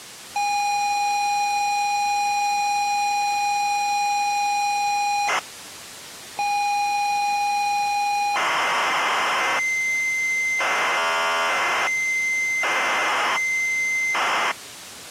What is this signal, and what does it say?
ZX Spectrum tape loading, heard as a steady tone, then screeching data.